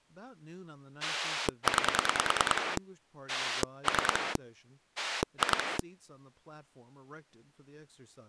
Pulse dialling, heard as a rotary dial, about 10 pulses a second, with speech in English. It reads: 9 3 2